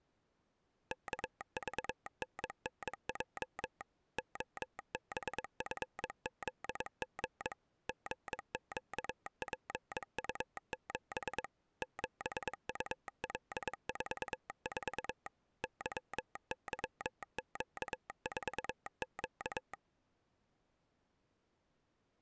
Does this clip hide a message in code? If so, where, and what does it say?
Yes: Morse code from 0.9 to 19.8 s, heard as a telegraph sounder, machine-sent, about 22 wpm. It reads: KVNNJ OBFZG GQPU7 7UL44 YYQ4Q